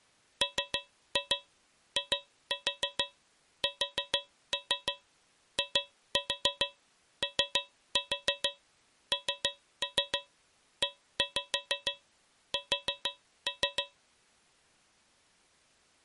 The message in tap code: MISIONES

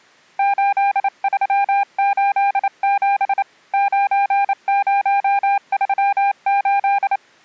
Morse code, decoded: 8387 9038

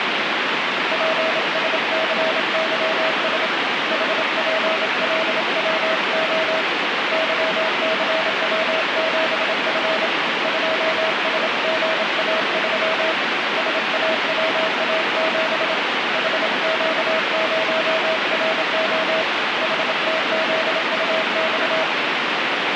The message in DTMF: none

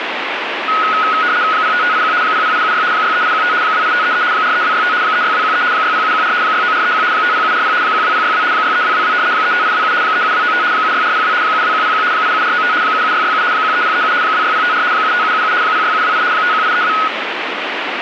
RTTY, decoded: 05581 00876 63815 28533 43265 36213 60714 69431 50740 12062 63222 35827 37295 76402 72101 87495 77667 13037 26054 75777 06728 51832

